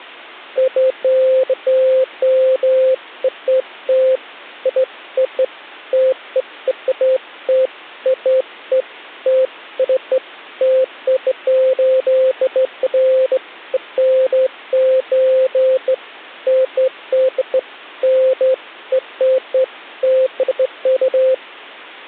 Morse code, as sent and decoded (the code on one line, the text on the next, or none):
none